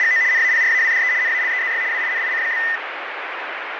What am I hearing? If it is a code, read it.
RTTY (75 baud, 170 Hz shift), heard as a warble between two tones, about 1900 Hz centre, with radio static. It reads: … NAPRAWDE NALEZY WINIC?